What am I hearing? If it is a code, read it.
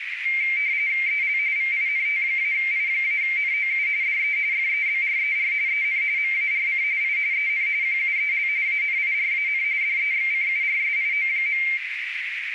RTTY (45.45 baud, 170 Hz shift), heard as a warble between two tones, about 2200 Hz centre, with radio static and a narrow filter. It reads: EL VINT-I-NOU DE FEBRER EN MARC I EN QUEL ANIRAN DEXCURSIO.